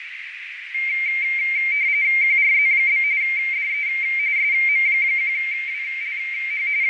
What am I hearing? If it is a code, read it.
RTTY (45.45 baud, 170 Hz shift), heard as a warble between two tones, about 2200 Hz centre, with radio static, fading and a narrow filter. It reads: QRZ? DE SM1WLH …